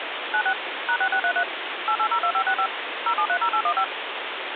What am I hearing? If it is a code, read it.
DTMF, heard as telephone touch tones, dialled by machine, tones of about 70 ms, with phone line noise. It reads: 96 #6633 8802565 0730815